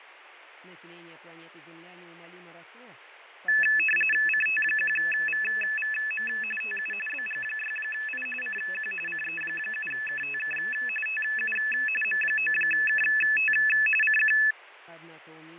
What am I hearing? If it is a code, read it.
RTTY (45.45 baud, 850 Hz shift), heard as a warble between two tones, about 2150 Hz centre, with radio static and fading. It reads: CT1VVM TU BG6I CQ CE7KTK TU M9KT CQ